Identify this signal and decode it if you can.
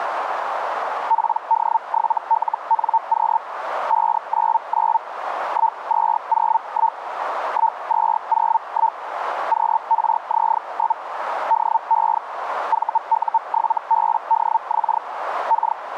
Hellschreiber (Feld-Hell, 122.5 baud), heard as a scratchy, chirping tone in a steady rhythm, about 900 Hz, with radio static and a narrow filter. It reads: PD7LNQ 599 1201 1201 QRZ? DE VU7BDX K